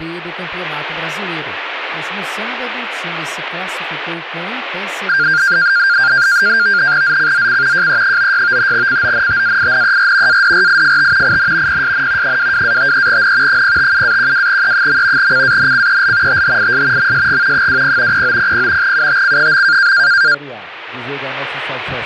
NAVTEX (SITOR-B), 100 baud, 170 Hz shift, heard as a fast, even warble, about 1500 Hz centre, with radio static. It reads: ZCZC JE96 CONTAINER ADRIFT IN PSN 22-53N 057-12E. CANCEL THIS MSG 20 0900 UTC.